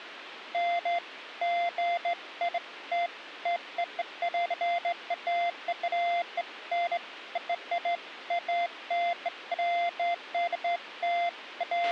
Beeps of irregular length, with radio hiss and a squelch burst at the end. There is no code.